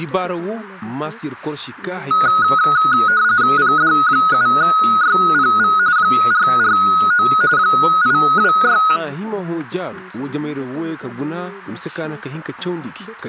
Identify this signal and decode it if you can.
RTTY (45.45 baud, 170 Hz shift), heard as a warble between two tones, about 1360 Hz centre. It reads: PD7YPV 449 826